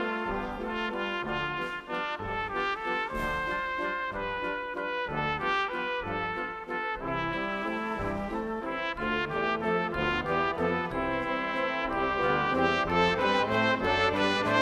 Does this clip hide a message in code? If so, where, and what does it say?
No.